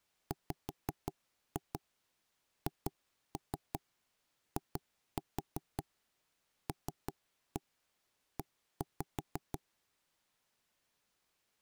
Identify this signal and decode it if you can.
Tap code, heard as knocks on wood, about 5 knocks a second. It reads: WHILE